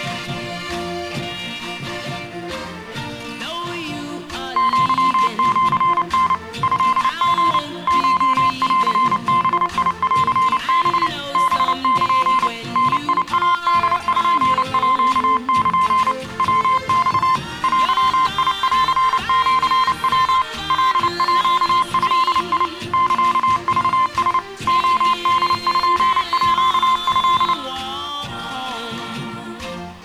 Morse code (Japanese Wabun code), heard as a keyed tone, machine-sent, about 29 wpm, 1040 Hz, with room echo. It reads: アシタ トリ コンバンハ ハル ダイポール ヤマ デンシヤ カード サクラ レポート